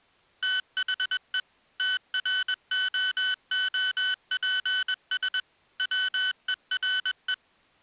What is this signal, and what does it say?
Morse code, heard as electronic beeps, machine-sent, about 21 wpm, 1500 Hz. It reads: THE TROOPS WERE